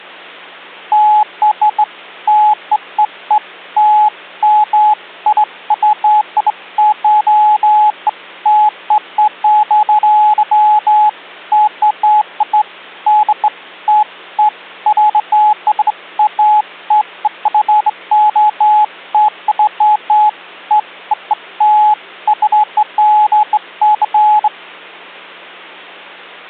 Beeps of irregular length, with hum. There is no code.